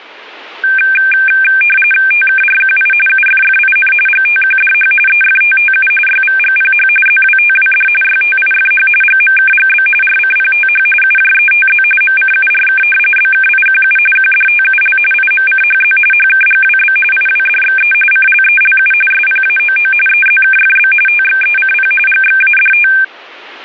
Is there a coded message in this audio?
Yes: RTTY (45.45 baud, 850 Hz shift) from 0.6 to 23.0 s, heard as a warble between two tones, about 2000 Hz centre. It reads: TKRQI UFFIN GTQDH EFTTU YVGPH ZWTWD YTIFH GMKGB RCPTH UJETZ MCURK BKIQU QDTUL IMCHZ HKGWB IWDXE CLELU SPAOO EZKFB TXECP GXADT